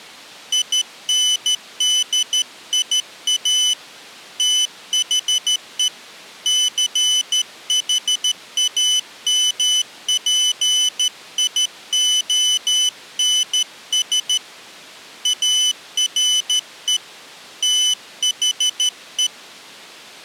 Morse code, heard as a high beeper, hand-sent with a straight key, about 13 wpm, 3000 Hz. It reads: INDIA THE CHAMPIONS ARE THE